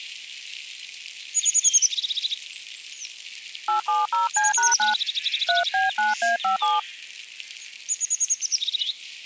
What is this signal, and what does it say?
DTMF, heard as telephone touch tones, dialled by hand, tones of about 140 ms. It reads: 870C#9 3B9A57